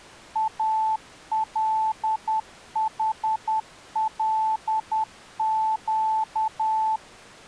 Morse code, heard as a keyed tone, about 10 wpm, 880 Hz. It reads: ALHLQ